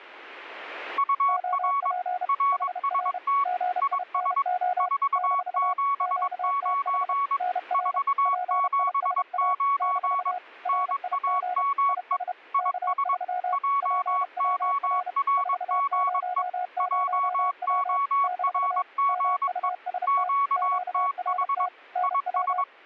Morse code, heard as two keyed tones. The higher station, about 22 wpm, 1120 Hz: UR RST IS 479 479 NAME IS JORGE JORGE QTH IS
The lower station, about 31 wpm, 720 Hz: OP HR GINO - QTH NR PISA - RIG IS K3 PWR 400W - MUST QRT NW